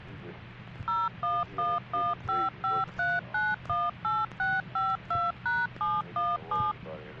DTMF, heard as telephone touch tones, dialled by machine, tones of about 200 ms. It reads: 0111553918652#717